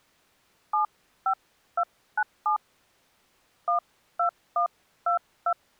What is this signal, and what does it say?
DTMF, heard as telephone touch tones, dialled by hand, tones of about 90 ms. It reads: 75297 12122